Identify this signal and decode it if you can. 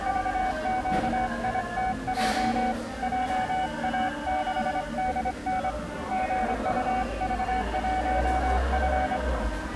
Morse code, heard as a keyed tone, hand-sent with a straight key, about 25 wpm, 750 Hz, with the noise of a cafe. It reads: VQITJ JA6DN GUV1F